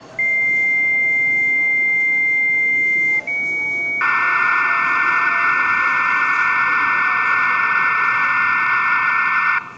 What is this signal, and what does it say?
Dial-up modem handshake (low-speed, two carriers), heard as two whistles, then hiss, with the noise of a subway station.